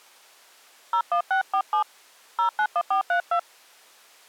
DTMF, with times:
0.9-1.8 01647
2.4-3.4 091432

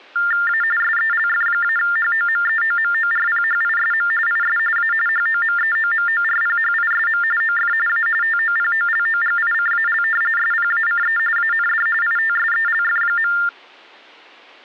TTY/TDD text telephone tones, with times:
0.5-0.6 A
0.8-4.1 SELF-HOMEOMORPHISM
4.3-4.6 IS
4.8-4.9 A
5.1-7.2 HOMEOMORPHISM
7.4-7.7 OF
7.9-8.1 A
8.2-10.0 TOPOLOGICAL
10.4-11.2 SPACE
11.4-11.9 AND
12.0-13.3 ITSELF.

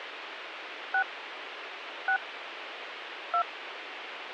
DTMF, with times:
0.9-1.0 6
2.1-2.2 6
3.3-3.4 2

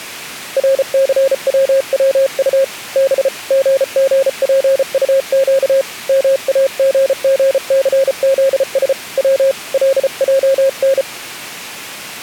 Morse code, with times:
0.6-2.6 RCWWU
3.0-3.3 B
3.5-5.8 GGPUQ
6.1-8.9 MAGGCZS
9.2-9.5 W
9.7-11.0 LJN

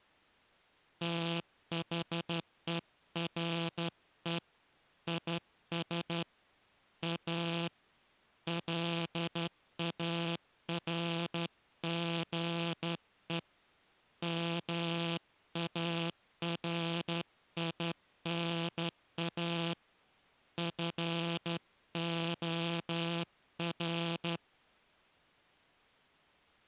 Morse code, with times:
1.0-4.4 THERE
5.1-6.2 IS
7.0-7.7 A
8.5-13.4 LARGE
14.2-19.7 MARINA
20.6-24.4 FOR

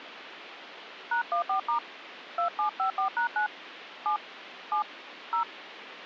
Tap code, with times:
none

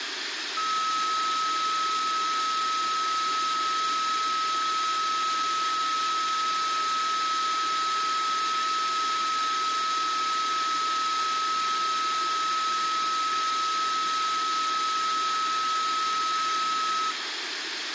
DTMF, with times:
none

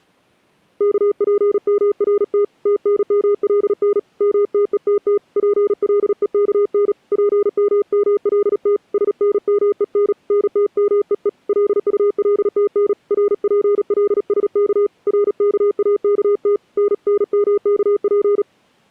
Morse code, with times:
0.8-2.4 KPMRT
2.7-4.0 TNMLN
4.2-5.2 MTETT
5.4-6.9 PLEKN
7.1-8.8 PMMLT
8.9-10.1 SNMEN
10.3-11.3 NTMEE
11.5-12.9 LULTN
13.1-14.9 RPLSK
15.1-16.6 RKAKT
16.8-18.4 NNMKP

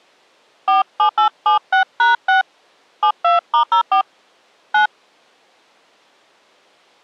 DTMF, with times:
0.7-2.4 47876#6
3.0-4.0 72*04
4.7-4.9 9

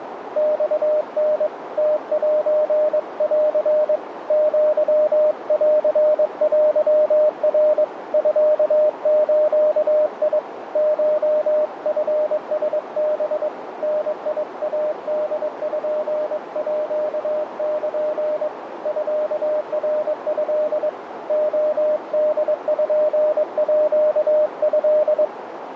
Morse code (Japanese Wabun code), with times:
0.4-1.5 マタ
1.8-4.0 ムセン
4.3-7.8 アンテナ
8.1-10.4 ミズ
10.8-13.5 コチラハ
13.8-18.5 ダイポール
18.9-20.9 ミナト
21.3-25.2 レポート

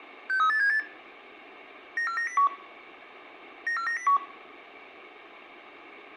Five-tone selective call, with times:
0.3-0.8 63878
2.0-2.5 94901
3.7-4.2 94901

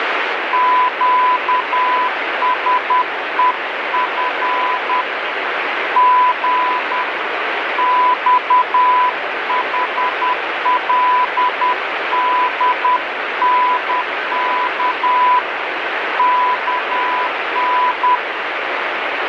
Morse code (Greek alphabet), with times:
0.5-5.0 ΨΣΕΦ
6.0-7.0 Γ
7.8-15.4 ΞΗΛΔΝΚ
16.2-18.2 ΚΝ

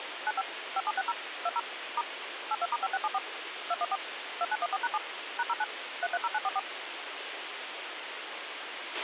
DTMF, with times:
0.3-0.4 95
0.8-1.1 5760
1.5-1.6 20
2.0-2.0 *
2.5-3.2 82*5674
3.7-4.0 214
4.4-5.0 2914#7
5.4-5.6 #09
6.0-6.6 330944

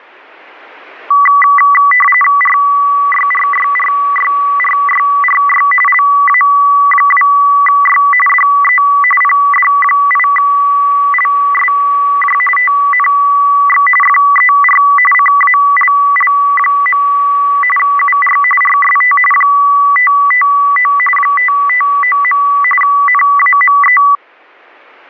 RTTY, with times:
2.4-5.7 RYRYRYRYRY
5.9-8.0 LA2Y
8.3-8.8 DE
9.2-12.4 PD8LSJ
12.6-13.9 TNX
14.0-14.8 FER
15.1-17.0 CALL.
17.8-18.4 UR
18.6-19.2 RST
19.3-20.9 559
21.2-22.4 559.
22.8-24.0 NAME

